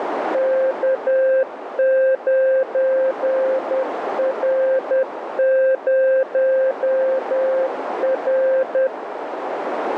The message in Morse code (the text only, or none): K9R0R